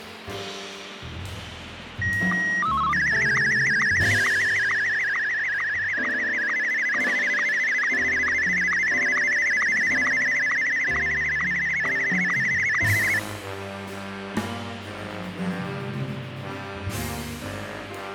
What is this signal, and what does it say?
SSTV (slow-scan television), Martin M1, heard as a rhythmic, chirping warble, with radio static.